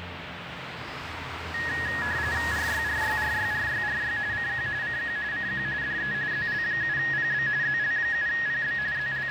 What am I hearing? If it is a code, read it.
RTTY (45.45 baud, 170 Hz shift), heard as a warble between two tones, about 1800 Hz centre, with radio static and street noise. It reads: RYRYRYRYRY CQ CQ CQ DE ZL7PB ZL7PB …